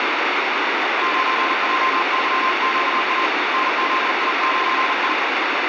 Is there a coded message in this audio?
Yes: Morse code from 1.0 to 5.2 s, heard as a keyed tone, hand-sent with a paddle, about 40 wpm, 1050 Hz, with heavy radio static. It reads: 9JYQA NZI9I